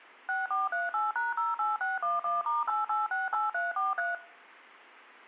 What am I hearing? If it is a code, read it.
DTMF, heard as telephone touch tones, dialled by machine, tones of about 170 ms. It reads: 6438#08611*8868343